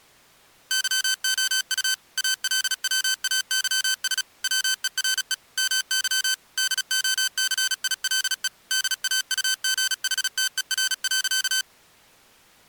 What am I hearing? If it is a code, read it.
Morse code, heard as electronic beeps, machine-sent, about 36 wpm, 1550 Hz. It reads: YOU ALWAYS WERE MY DOCILE DAUGHTER.